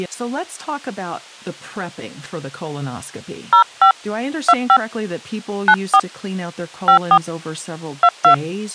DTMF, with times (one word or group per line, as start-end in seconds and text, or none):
3.5-3.9 05
4.5-4.8 25
5.7-6.0 94
6.9-7.2 54
8.0-8.3 22